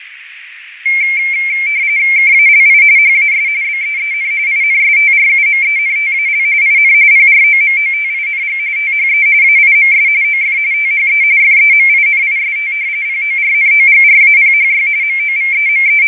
RTTY (45.45 baud, 170 Hz shift), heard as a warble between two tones, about 2250 Hz centre, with radio static, fading and a narrow filter. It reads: KALI HAS BEEN INSTRUMENTAL IN PROMOTING THE AIMS OF THE FEMINIST PORNOGRAPHY …